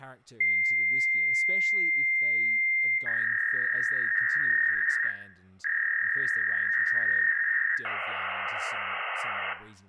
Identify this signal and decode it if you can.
Fax machine handshake, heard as a long tone, a warble and hiss, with room echo and speech in English.